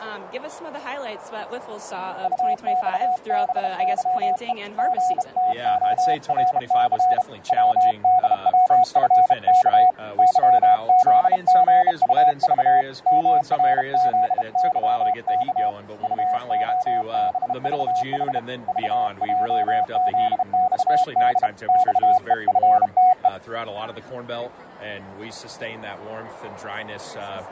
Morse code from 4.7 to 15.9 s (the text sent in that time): GTORC WDWFK YZGUV MRZYK